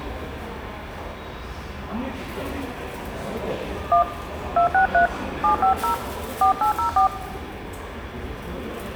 DTMF, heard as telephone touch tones, dialled by hand, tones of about 110 ms, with the noise of a subway station. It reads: 1 263 750 4804